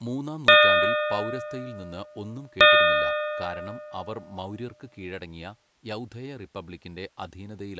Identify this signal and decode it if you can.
Clock strike, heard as a bell, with speech in Malayalam. 2. Two o'clock.